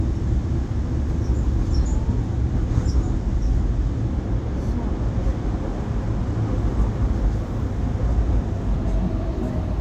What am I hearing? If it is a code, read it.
The noise inside a subway train. There is no code.